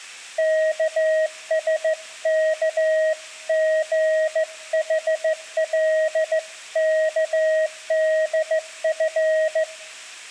Morse code (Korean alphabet), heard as a keyed tone, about 15 wpm, 630 Hz, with room echo. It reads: 영숙은